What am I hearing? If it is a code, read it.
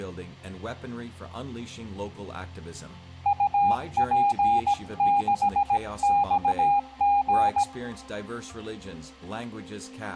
Morse code, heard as a keyed tone, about 17 wpm, 810 Hz, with room echo. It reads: UP6XG